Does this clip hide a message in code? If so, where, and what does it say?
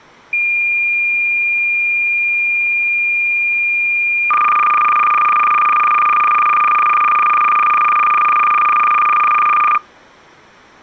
Yes: cassette data (Kansas City type), 300 baud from 0.3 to 9.8 s, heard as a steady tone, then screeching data.